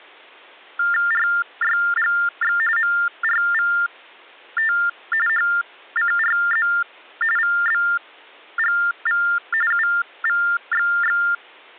TTY/TDD text telephone tones (45.45 baud Baudot), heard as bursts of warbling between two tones, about 400 Hz shift, 1600 Hz centre. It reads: RYGX MRVT HCRZ VBGV UVXX